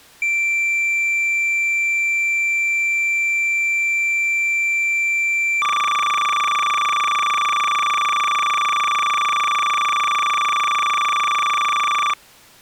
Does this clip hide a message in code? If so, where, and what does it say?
Yes: cassette data (Kansas City type), 300 baud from 0.2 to 12.1 s, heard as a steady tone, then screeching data.